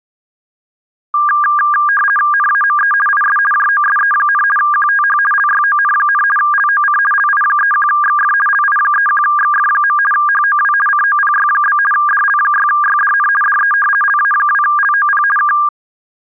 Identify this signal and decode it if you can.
RTTY (50 baud, 450 Hz shift), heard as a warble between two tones, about 1410 Hz centre. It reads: NAME IS JOSE, QTH LYON, LOC LI31XF LI31XF. HOW COPY? DL6YDN DE LA2LOP K